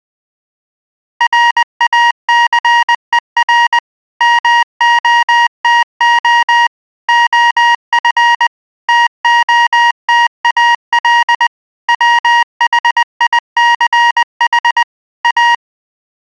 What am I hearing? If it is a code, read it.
Morse code, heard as electronic beeps, machine-sent, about 20 wpm, 950 Hz. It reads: RACER MOTO OF TOTAL WHICH A